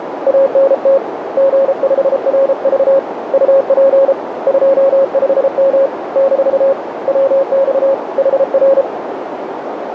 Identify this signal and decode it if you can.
Morse code, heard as a keyed tone, hand-sent with a paddle, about 33 wpm, 540 Hz, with radio static and a narrow filter. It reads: ANT G5RV UP 25M - WX HR